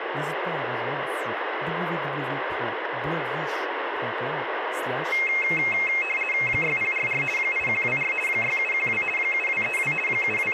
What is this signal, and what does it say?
RTTY (50 baud, 450 Hz shift), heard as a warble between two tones, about 2350 Hz centre, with radio static and speech in French. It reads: 6044 8124 6712 7232 …